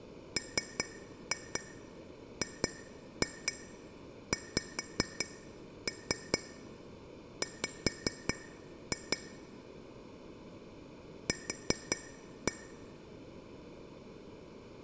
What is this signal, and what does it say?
Tap code, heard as taps on glass, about 4 knocks a second. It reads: MGXW Q